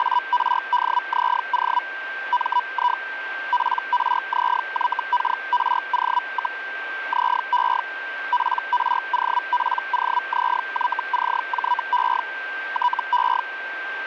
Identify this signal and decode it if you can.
Hellschreiber (Feld-Hell, 122.5 baud), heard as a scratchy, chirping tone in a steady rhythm, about 980 Hz, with radio static and a steady whistle near 1570 Hz. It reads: … MI PRZYKRO, ZE PROPOZYCJE TE